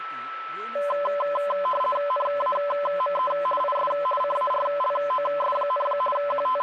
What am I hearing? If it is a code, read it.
RTTY (50 baud, 450 Hz shift), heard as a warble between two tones, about 800 Hz centre, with a steady whistle near 1320 Hz and speech in Kannada. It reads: NAME IS CARLOS, …